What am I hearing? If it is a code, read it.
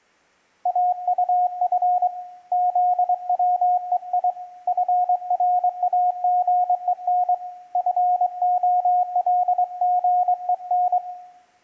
Morse code, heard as a keyed tone, hand-sent with a straight key, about 23 wpm, 720 Hz, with room echo. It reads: AUF ZWEI FRAGEN FOLGEN